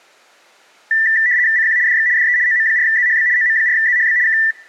RTTY (75 baud, 170 Hz shift), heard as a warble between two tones, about 1850 Hz centre. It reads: CQ DX DE OM4ZHB OM4ZHB K